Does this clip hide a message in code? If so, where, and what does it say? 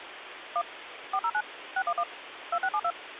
Yes: DTMF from 0.6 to 2.9 s, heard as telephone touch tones, dialled by machine, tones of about 60 ms, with phone line noise. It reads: 1 409 611 2672